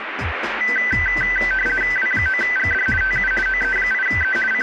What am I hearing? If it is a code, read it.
RTTY (50 baud, 450 Hz shift), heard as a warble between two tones, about 1750 Hz centre, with radio static. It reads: W9GD TU OE8E …